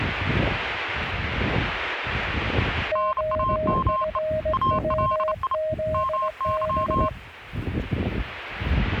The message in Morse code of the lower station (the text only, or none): OFWZB